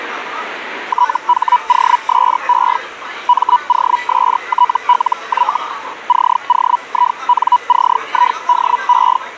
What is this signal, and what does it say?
Hellschreiber (Feld-Hell, 122.5 baud), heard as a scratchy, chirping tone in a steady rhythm, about 980 Hz, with the noise of a restaurant. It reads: THOSE MOSTLY COINCIDE